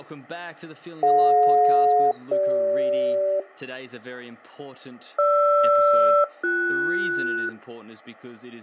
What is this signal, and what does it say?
Aircraft SELCAL, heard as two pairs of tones, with speech in English. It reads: DJ-CG GR-BS